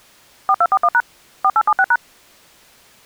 DTMF, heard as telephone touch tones, dialled by machine, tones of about 50 ms. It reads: 4241# 4876#